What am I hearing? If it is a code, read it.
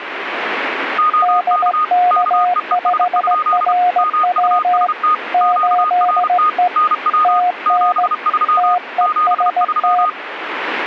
Morse code, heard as two keyed tones, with radio static. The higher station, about 32 wpm, 1240 Hz: OK KEES? MUST QRT NW 73 73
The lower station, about 17 wpm, 720 Hz: DK5RW 8E TN TEST